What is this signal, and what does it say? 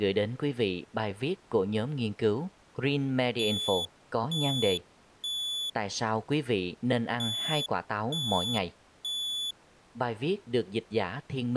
Alarm pattern, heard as an alarm's beeps, played twice, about 3450 Hz, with speech in Vietnamese. Temporal three. Smoke or fire, evacuate.